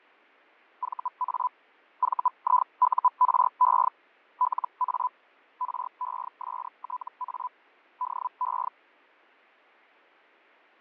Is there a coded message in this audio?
Yes: Hellschreiber (Feld-Hell, 122.5 baud) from 0.8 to 8.7 s, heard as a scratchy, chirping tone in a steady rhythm, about 1000 Hz, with fading. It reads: VA VIURE LA RESTA DE